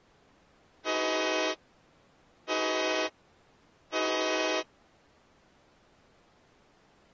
Train horn signal, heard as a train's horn. 3 short. On North American railways: when stopped, the train will back up.